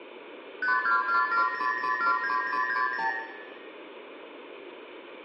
Multi-frequency trunk signalling (R2, with the far end's replies), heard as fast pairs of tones, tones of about 120 ms, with room echo. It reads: 52470079060